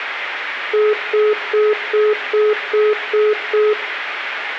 Telephone call progress tone (single-tone plan, as in most of Europe), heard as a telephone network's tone, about 420 Hz, 0.2 s on and 0.2 s off, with room echo. Congestion tone.